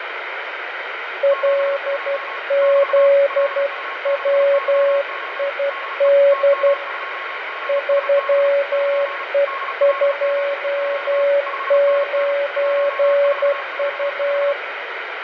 Morse code, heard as two keyed tones, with radio static, fading and room echo. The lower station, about 12 wpm, 560 Hz: LZWID 3E29U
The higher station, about 35 wpm, 1090 Hz: 72 <BT> LU6YO DE TM2GSB <KN> DL7Q 5NN 1445